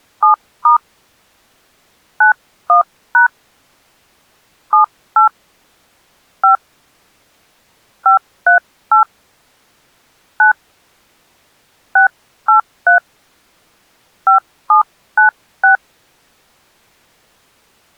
DTMF, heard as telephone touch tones, dialled by hand, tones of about 120 ms. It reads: 7* 91# 78 5 538 9 683 5796